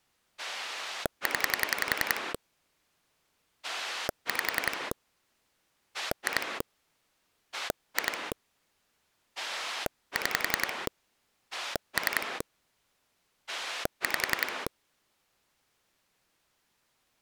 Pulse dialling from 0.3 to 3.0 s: 0

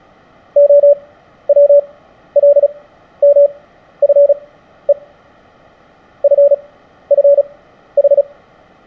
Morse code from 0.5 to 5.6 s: OWLMFE

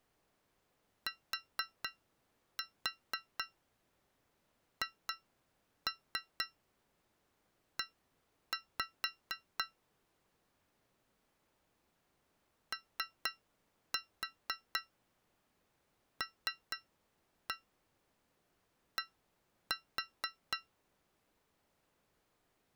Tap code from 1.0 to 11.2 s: THE

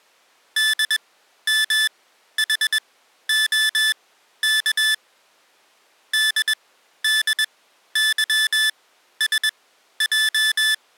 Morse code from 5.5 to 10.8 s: DDYSJ

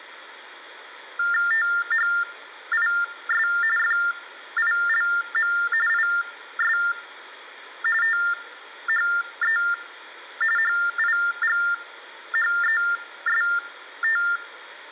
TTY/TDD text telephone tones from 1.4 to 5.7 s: THIS FILM

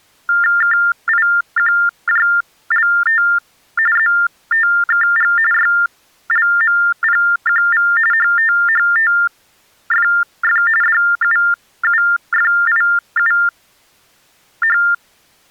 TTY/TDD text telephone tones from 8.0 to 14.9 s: HTHTFF DUUFIUH

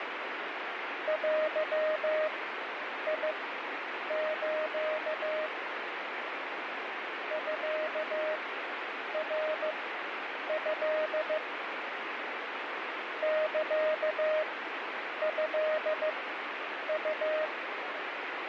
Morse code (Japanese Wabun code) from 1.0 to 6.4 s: デス

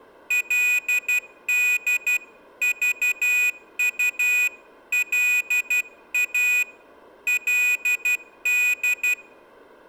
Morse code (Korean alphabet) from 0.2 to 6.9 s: 그리고

